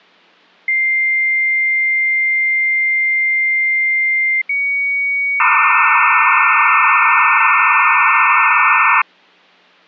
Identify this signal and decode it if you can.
Dial-up modem handshake (low-speed, two carriers), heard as two whistles, then hiss.